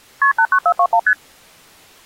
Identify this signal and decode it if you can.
Multi-frequency trunk signalling (R1, as on North American trunks), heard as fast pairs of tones, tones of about 70 ms. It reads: KP 89421 ST